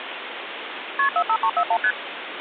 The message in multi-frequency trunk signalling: KP 45341 ST

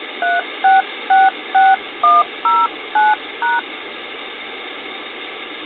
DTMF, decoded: 3666109#

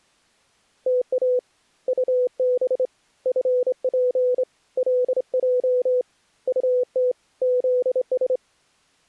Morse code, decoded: TA UB FP LJ UT ZS

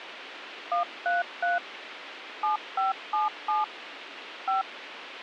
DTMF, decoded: 133 7577 5

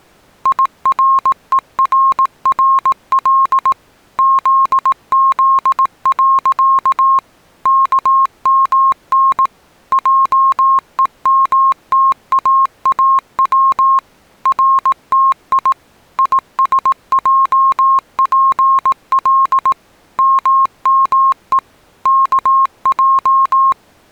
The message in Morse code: IRERRL ZZ. KMN JEMTAAW RTI ISJPL MME KJ

